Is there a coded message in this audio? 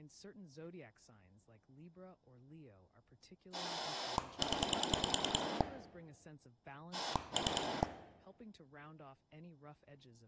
Yes: pulse dialling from 3.5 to 7.8 s, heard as a rotary dial, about 10 pulses a second, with room echo and speech in English. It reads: 0 3